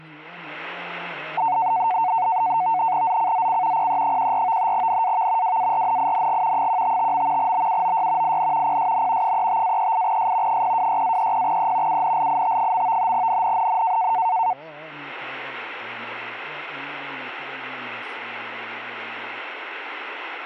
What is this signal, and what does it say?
NAVTEX (SITOR-B), 100 baud, 170 Hz shift, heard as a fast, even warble, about 820 Hz centre, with static crashes. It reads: ZCZC PE14 NAV WARNING 155. BUOY IN PSN 35-38S 026-30E UNLIT. NNNN